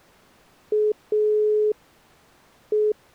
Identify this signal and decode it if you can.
Telephone call progress tone (pulsed, as in Italy), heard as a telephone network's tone, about 420 Hz. Dial tone.